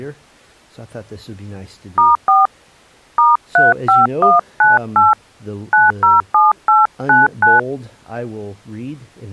DTMF, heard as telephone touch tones, dialled by hand, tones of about 170 ms. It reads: *4 *35198 907899